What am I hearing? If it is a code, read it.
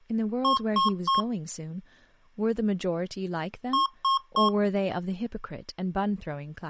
Beep code, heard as beeps from a small speaker, played twice, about 1080 Hz, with speech in English. 3 short. In AMI BIOS tables: failure in the first 64 KB of memory; in Dell tables: chipset error.